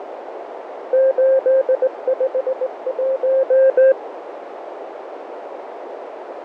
Morse code, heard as a keyed tone, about 19 wpm, 530 Hz, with radio static, fading and a narrow filter. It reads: 851